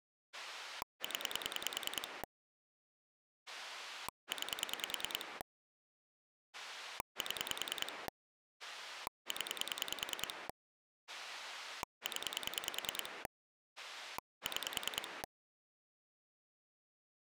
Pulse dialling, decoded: 0 9 7 0 0 6

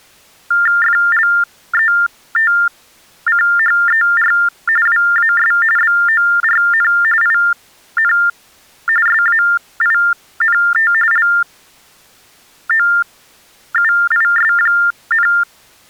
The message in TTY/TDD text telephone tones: FLETCHER WAS BORN IN SAINT LOUIS,

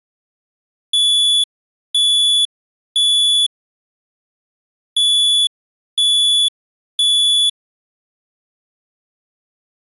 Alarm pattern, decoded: temporal three

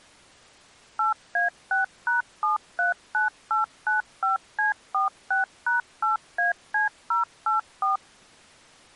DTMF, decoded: 8A6#739895C46#8AC084

